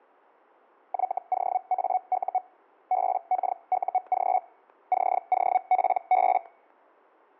Hellschreiber (Feld-Hell, 122.5 baud), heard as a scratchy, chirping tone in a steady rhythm, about 740 Hz, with static crashes. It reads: YOAU BKUG COPB